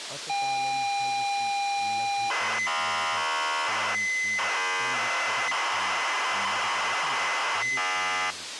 ZX Spectrum tape loading, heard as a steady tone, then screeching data, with tape hiss and speech in Manipuri.